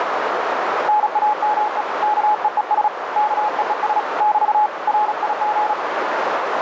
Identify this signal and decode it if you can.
Morse code, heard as a keyed tone, hand-sent with a paddle, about 36 wpm, 840 Hz, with radio static and a narrow filter. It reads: NAME KEES KEES <BT> RIG